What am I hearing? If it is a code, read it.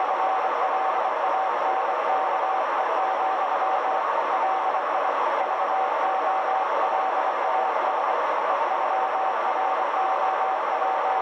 Morse code (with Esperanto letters), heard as a keyed tone, hand-sent with a bug key, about 24 wpm, 760 Hz, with heavy radio static and a narrow filter. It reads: … LI VOLAS …